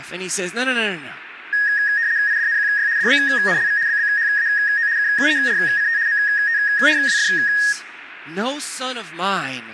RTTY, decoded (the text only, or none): IDNQY DBNLV BBHAO KERCT MTRWF